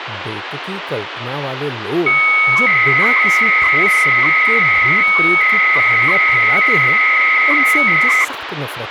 300-baud modem data (Bell 103 tones), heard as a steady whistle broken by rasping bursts, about 300 baud, 200 Hz shift, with phone line noise and speech in Hindi.